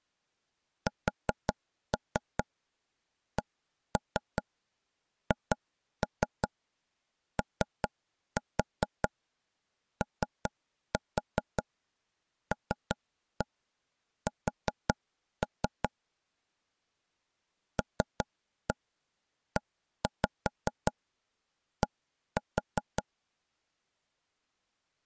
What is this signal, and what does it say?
Tap code, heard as taps on a table, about 5 knocks a second. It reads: SCHOOLS LED